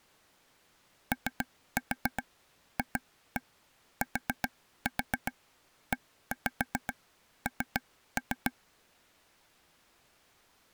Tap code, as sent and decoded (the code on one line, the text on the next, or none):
3-4 2-1 4-4 1-5 3-3
OFTEN